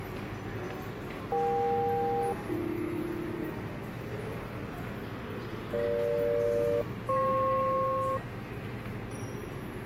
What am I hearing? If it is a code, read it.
Aircraft SELCAL, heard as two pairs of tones, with static crashes and the noise of a subway station. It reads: EK-AB EG-FP